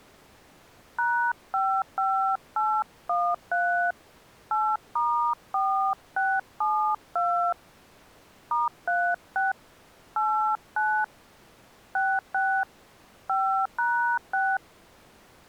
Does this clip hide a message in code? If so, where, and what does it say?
Yes: DTMF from 1.0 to 14.6 s, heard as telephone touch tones, dialled by hand, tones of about 280 ms. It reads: #55813 8*4672 *36 89 66 5#6